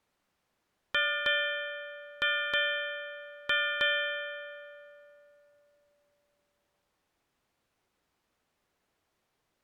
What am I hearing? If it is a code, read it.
Ship's bell, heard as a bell. 6. Six half-hours of the watch have passed.